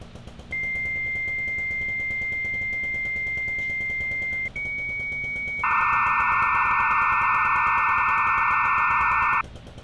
Dial-up modem handshake (low-speed, two carriers), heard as two whistles, then hiss, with street noise.